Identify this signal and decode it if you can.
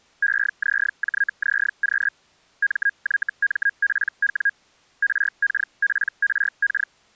Hellschreiber (Feld-Hell, 122.5 baud), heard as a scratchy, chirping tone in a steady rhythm, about 1650 Hz. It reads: EZJZQ MYMPW RKPRK